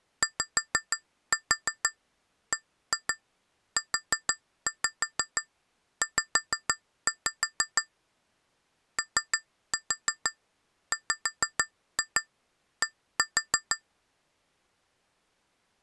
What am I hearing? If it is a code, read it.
Tap code, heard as taps on glass, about 6 knocks a second. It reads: YBUZ OWD